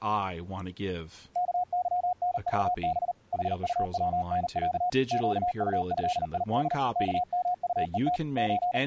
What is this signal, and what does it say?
Morse code (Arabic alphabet), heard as a keyed tone, machine-sent, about 39 wpm, 730 Hz, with speech in English. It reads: كظنضب حطونع قطهيد كمطءت …